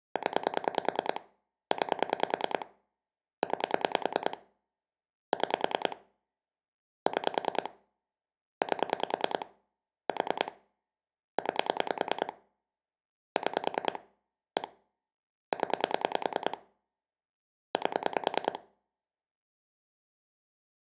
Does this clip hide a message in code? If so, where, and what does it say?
Yes: pulse dialling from 0.2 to 18.6 s, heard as clicks on a phone line, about 10 pulses a second. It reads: 0 9 9 6 6 8 4 9 6 1 0 8